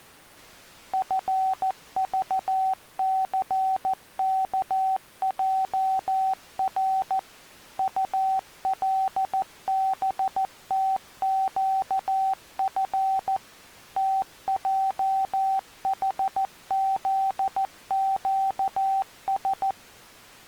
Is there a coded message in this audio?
Yes: Morse code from 0.9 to 19.8 s, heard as a keyed tone, machine-sent, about 14 wpm, 770 Hz. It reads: FVCKJR ULBTQF TJHZQS